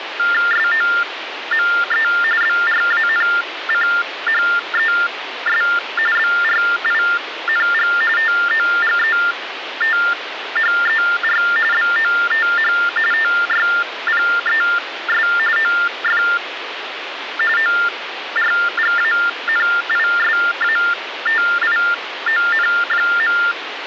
TTY/TDD text telephone tones (45.45 baud Baudot), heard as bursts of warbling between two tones, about 400 Hz shift, 1600 Hz centre, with phone line noise. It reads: SOME BRANCHES BRING TOGETHER BOTH TYPES OF ORGANISATION.